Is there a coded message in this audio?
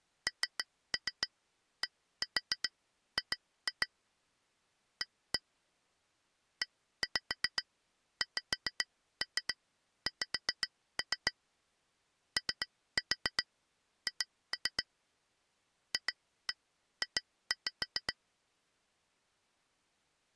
Yes: tap code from 0.3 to 18.1 s, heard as taps on glass, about 7 knocks a second. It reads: NDG A EXX OH FJ